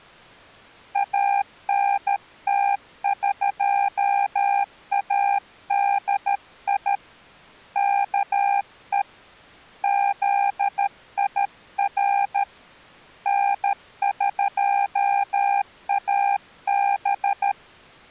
Morse code (Persian alphabet), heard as a keyed tone, hand-sent with a paddle, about 13 wpm, 800 Hz. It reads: انتقادی که زیر نقاب